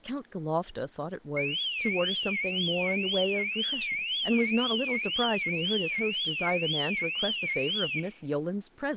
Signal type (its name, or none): none